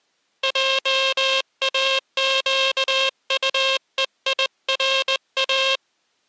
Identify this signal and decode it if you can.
Morse code, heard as a buzzer, hand-sent with a straight key, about 20 wpm. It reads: JAQUEIRA